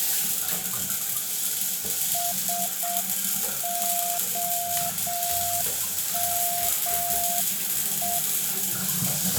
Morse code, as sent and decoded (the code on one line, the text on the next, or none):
... --- -- .
SOME